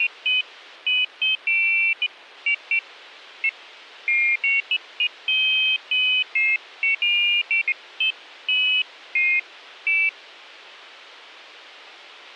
Pairs of high tones at irregular times. There is no code.